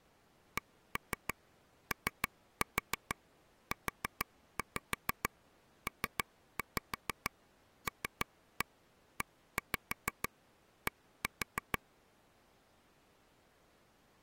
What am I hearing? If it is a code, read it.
Tap code, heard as taps on a table, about 6 knocks a second. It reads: COUPLED